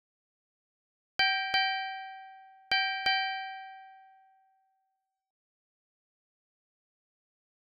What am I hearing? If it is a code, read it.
Ship's bell, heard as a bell. 4. Four half-hours of the watch have passed.